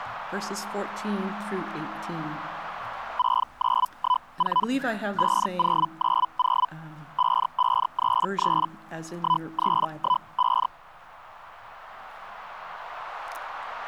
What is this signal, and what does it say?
Hellschreiber (Feld-Hell, 122.5 baud), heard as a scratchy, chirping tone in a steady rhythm, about 1000 Hz. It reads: 6914 5090 5533 1315